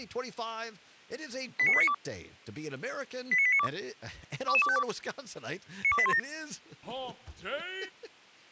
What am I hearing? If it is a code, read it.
Five-tone selective call (ZVEI), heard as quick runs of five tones, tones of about 70 ms. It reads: 89892 89892 22252 92817